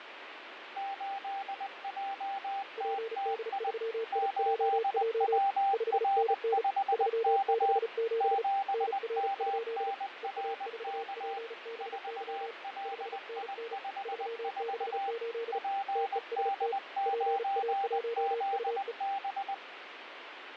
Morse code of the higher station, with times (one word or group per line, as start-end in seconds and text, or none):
0.8-3.7 8JTTI
4.1-7.8 8WR5K
8.2-11.4 7MNRK
11.8-15.1 4LI54
15.5-19.5 PD9ZB